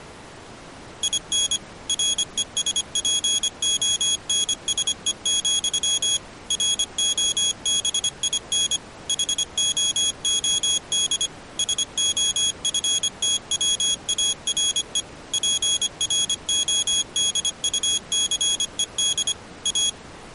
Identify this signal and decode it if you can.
Morse code, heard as a high beeper, machine-sent, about 25 wpm, 3350 Hz. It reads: IN RESPONSE, ROBIN HOOD SOFTWARE PRODUCED A